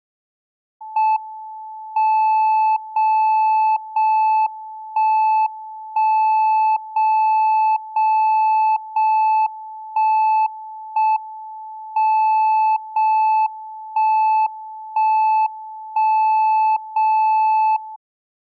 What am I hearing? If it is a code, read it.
Radio time signal (JJY), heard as a tone whose level steps once a second, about 870 Hz. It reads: M 0 0 1 1 0 0 0 1 1 M 0 1 1 1 0 0